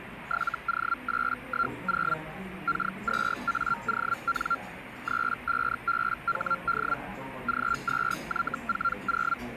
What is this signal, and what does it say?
Hellschreiber (Feld-Hell, 122.5 baud), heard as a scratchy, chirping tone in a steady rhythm, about 1380 Hz, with radio static and the noise of a cafe. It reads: 7O810 K2AON 35BHD G2Y40